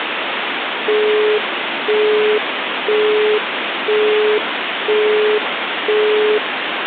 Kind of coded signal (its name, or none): telephone call progress tone